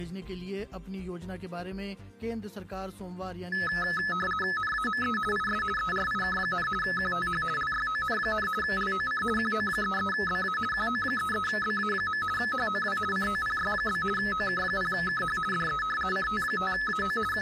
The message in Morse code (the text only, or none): none